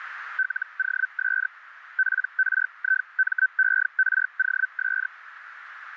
Hellschreiber (Feld-Hell, 122.5 baud), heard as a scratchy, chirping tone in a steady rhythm, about 1550 Hz, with radio static and a narrow filter. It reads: LOS PRIMEROS